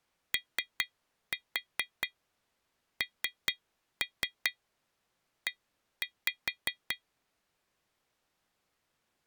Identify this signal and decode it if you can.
Tap code, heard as taps on glass, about 4 knocks a second. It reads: ONE